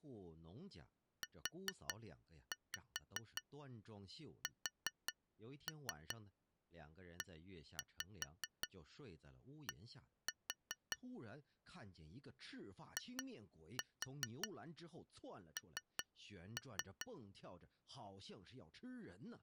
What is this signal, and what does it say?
Tap code, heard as taps on glass, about 5 knocks a second, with speech in Chinese. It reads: USED IN